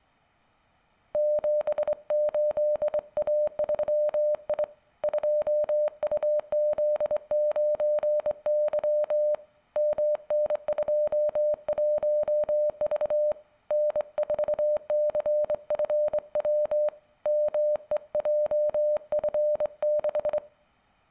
Morse code, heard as a keyed tone, hand-sent with a straight key, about 24 wpm, 600 Hz. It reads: 78A3I 2UZ9Y MN21V N4CFW MEJF6